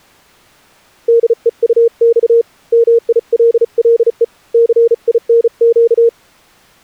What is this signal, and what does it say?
Morse code, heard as a keyed tone, hand-sent with a paddle, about 35 wpm, 460 Hz. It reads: DEUX MILLE CINQ